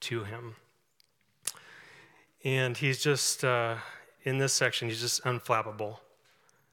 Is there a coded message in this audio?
No.